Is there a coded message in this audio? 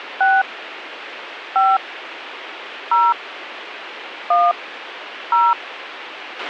Yes: DTMF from 0.2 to 5.5 s, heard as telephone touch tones, dialled by hand, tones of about 210 ms, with radio hiss and a squelch burst at the end. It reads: 6 5 0 1 0